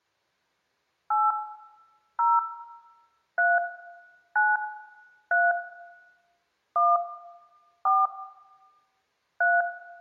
DTMF, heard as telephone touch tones, dialled by hand, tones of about 200 ms, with room echo. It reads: 8 0 3 9 3 1 4 3